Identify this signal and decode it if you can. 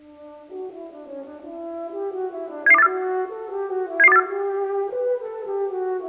Five-tone selective call (EEA), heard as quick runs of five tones, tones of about 40 ms. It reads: 77284 77284